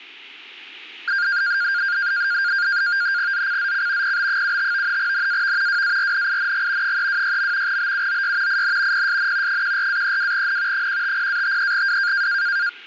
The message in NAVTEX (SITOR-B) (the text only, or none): ZCZC PB75 NAV WARNING 326. BUOY IN PSN 14-32N 150-53W